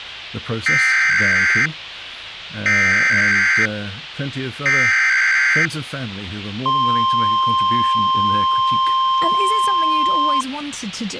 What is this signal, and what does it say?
Emergency Alert System (SAME) tones (header bursts, then the 1050 Hz attention tone), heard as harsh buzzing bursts, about 520.83 baud.